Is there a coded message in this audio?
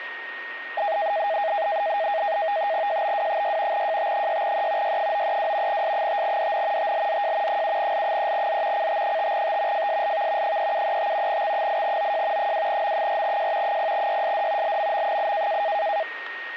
Yes: NAVTEX (SITOR-B), 100 baud, 170 Hz shift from 0.8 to 16.0 s, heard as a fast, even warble, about 730 Hz centre, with radio static and a steady whistle near 1860 Hz. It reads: JBW6 JT6E Y932 S5DN TLZJ 7L3Z CT5T FSLV 3735 X8OJ 2M4J 0YSD LMM8